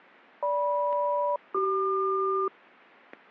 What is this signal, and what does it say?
Aircraft SELCAL, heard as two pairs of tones, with static crashes. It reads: GM-CQ